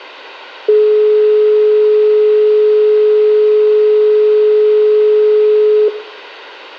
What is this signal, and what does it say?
Telephone call progress tone (425 Hz plan, as in most of Europe), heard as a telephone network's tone, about 420 Hz, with room echo. Dial tone.